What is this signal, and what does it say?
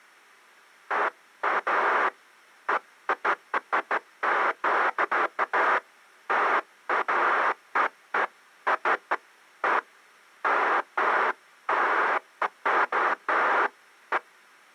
Bursts of noise. There is no code.